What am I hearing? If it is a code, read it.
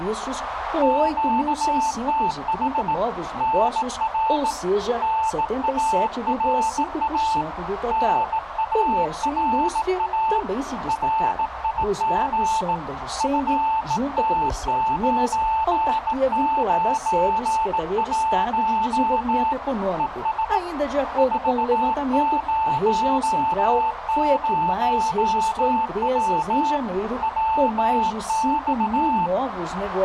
Morse code, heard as a keyed tone, hand-sent with a bug key, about 18 wpm, 880 Hz, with radio static and a narrow filter. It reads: QTH NR NARA NARA RIG FT991 ES 400W WX